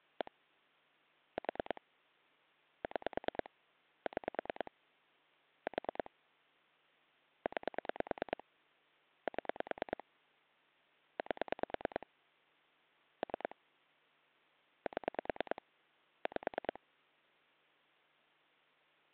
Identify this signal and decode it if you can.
Pulse dialling, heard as clicks on a phone line, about 9 pulses a second. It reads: 1 4 6 6 4 9 7 8 3 7 5